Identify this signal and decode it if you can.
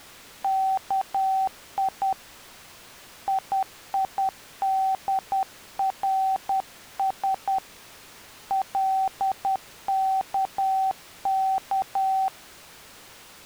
Morse code (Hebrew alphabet), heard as a keyed tone, hand-sent with a paddle, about 10 wpm, 770 Hz. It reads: כי יידרש לכך